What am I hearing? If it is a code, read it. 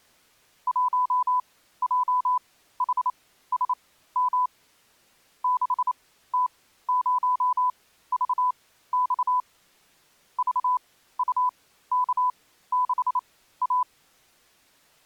Morse code, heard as a keyed tone, machine-sent, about 28 wpm, spaced as for 15 wpm, 1000 Hz. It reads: 1JHSM 6T0VX VUK6A